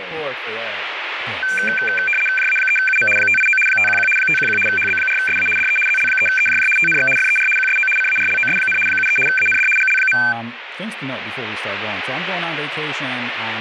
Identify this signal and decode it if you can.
RTTY (75 baud, 850 Hz shift), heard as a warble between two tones, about 1950 Hz centre, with radio static and speech in English. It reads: JA3UM 589 511 511 HB4SA DE ZL3EJJ TNX FER QSO CARLOS, 73 AND GL.